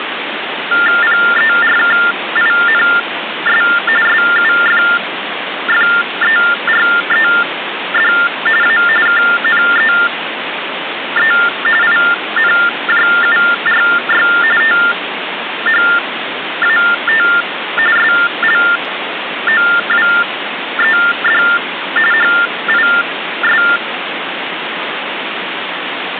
TTY/TDD text telephone tones (45.45 baud Baudot), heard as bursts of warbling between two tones, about 400 Hz shift, 1600 Hz centre, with phone line noise. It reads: PERKINS SUFFERED A KNEE INJURY THAT SLOWED HIS